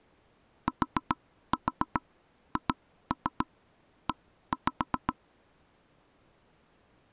Tap code, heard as taps on a table, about 7 knocks a second. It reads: THE